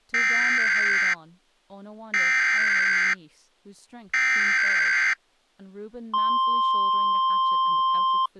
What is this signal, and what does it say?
Emergency Alert System (SAME) tones (header bursts, then the 1050 Hz attention tone), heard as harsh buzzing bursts, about 520.83 baud, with speech in English.